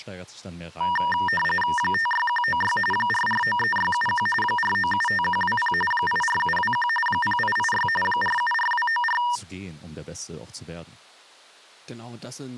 RTTY (45.45 baud, 850 Hz shift), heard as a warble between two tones, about 1390 Hz centre, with speech in German. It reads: 56196 4493671 4975120 84721 0886 474294